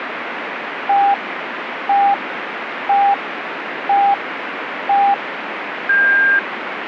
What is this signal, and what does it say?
Radio time signal (five pips and a higher one, as on Chinese radio), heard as pips, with radio static.